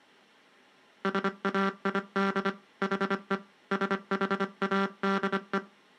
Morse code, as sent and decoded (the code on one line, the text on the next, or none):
... .- .. -.. / .... . / ... .... .- -.. .
SAID HE SHADE